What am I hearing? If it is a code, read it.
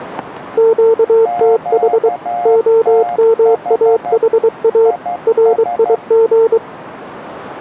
Morse code, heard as two keyed tones. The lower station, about 23 wpm, 450 Hz: QTH OMAHA RIG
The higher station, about 12 wpm, 710 Hz: QTH IS